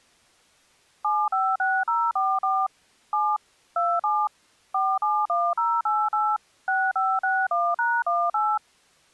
DTMF, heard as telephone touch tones, dialled by machine, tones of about 240 ms. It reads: 756044 7 27 471088 6561#18